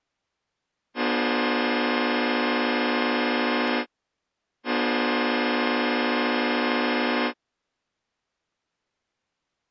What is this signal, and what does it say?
Train horn signal, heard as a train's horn. 2 long. On North American railways: brakes released, proceed.